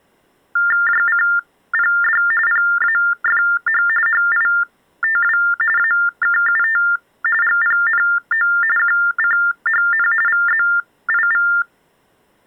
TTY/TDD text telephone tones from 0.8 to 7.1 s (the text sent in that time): JCPD PAFH HITW AKUT